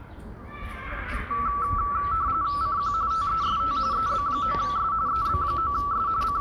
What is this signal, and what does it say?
RTTY (45.45 baud, 170 Hz shift), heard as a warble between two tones, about 1230 Hz centre, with the noise of a residential street. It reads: CQ TEST EB9S EB9S …